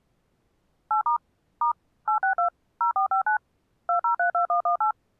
DTMF, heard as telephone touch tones, dialled by machine, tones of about 110 ms. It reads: 8* * 862 0459 2032118